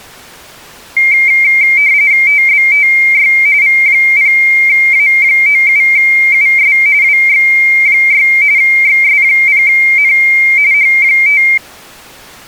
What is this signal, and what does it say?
RTTY (45.45 baud, 170 Hz shift), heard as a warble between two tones, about 2200 Hz centre. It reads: TBTY V0A97US WX6 XS0N H5